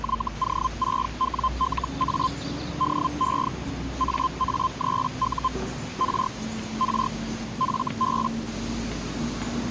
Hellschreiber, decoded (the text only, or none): YO6WLA DE AA3U R R FB